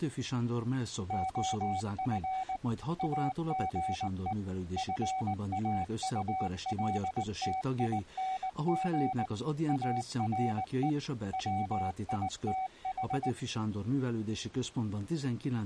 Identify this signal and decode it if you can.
Morse code, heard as a keyed tone, machine-sent, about 19 wpm, 760 Hz. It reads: OF AGE FAULTING ARE WITH